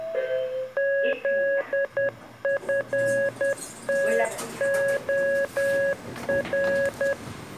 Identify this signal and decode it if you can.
Morse code, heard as a keyed tone, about 10 wpm, 550 Hz, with the noise inside a lift. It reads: ZFTOR